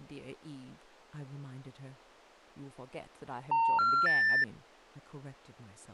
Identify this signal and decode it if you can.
Telephone call progress tone (North American plan), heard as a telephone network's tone, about 910, 1370, 1800 Hz, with speech in English. Special information tone.